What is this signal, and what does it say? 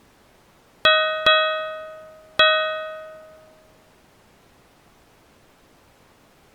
Ship's bell, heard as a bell. 3. Three half-hours of the watch have passed.